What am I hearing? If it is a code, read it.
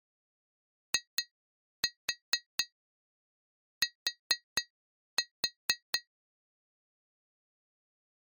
Tap code, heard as taps on glass, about 4 knocks a second. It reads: IT